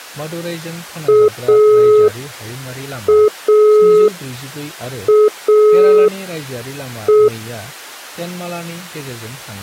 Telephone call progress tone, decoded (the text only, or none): dial tone